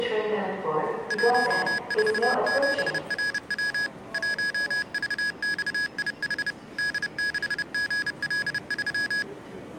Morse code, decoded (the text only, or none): 147RW 1VXIH D6GL3